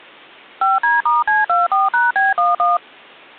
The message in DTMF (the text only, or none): 5D*C24#B11